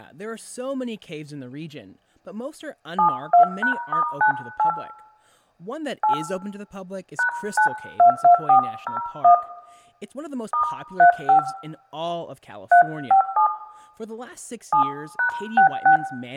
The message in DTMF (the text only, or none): 72#*98 8 #922401 *35 357 7#66